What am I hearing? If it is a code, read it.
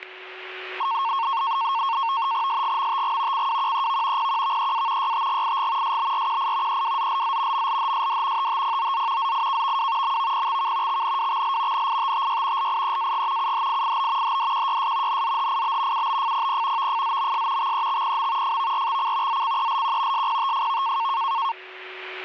NAVTEX (SITOR-B), 100 baud, 170 Hz shift, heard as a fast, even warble, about 1000 Hz centre, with static crashes and a steady whistle near 370 Hz. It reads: SGMTG CWQEV PQVEA YTGIG SBRQI EWZLZ MLHSD TTPOZ ZIKVW MVPXK XNWXL NITTY LIEAG UHIIB HDQYS NZHIB UBFPP VFZMS XEXPM FVRXC ZCELQ SPTFV